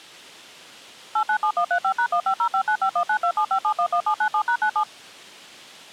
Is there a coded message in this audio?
Yes: DTMF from 1.2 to 4.8 s, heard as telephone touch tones, dialled by machine, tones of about 80 ms. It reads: 897135#15059519275711797#97